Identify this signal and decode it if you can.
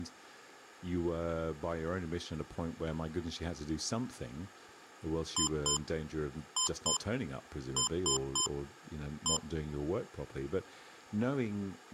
Beep code, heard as beeps from a small speaker, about 1030 Hz, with speech in English. 2-2-3-1. In Phoenix BIOS tables: unexpected interrupt.